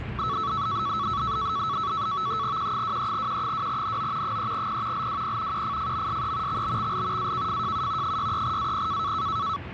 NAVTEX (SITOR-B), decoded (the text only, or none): Q23Q2NO 3P LWP QFFMSE XBXL AKFJU 63AP